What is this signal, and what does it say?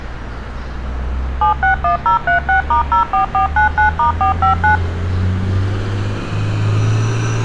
DTMF, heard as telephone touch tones, dialled by machine, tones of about 120 ms, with street noise. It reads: 761036*04499*459